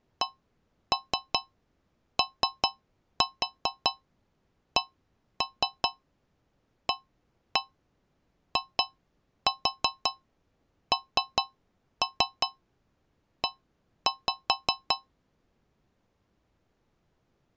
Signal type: tap code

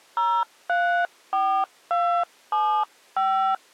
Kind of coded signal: DTMF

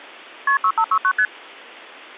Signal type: multi-frequency trunk signalling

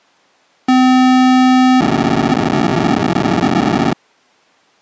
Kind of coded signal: POCSAG pager data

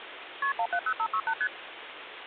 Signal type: multi-frequency trunk signalling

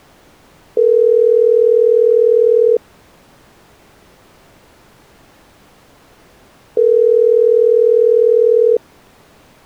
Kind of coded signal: telephone call progress tone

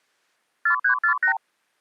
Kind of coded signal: multi-frequency trunk signalling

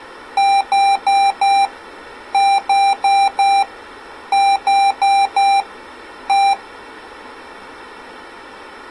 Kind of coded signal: beep code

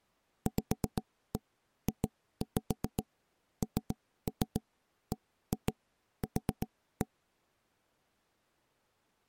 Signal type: tap code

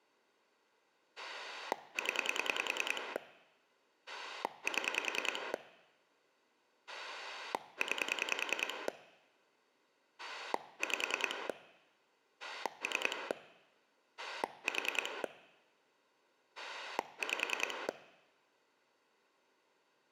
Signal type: pulse dialling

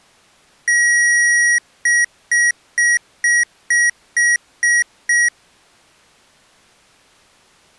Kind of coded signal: beep code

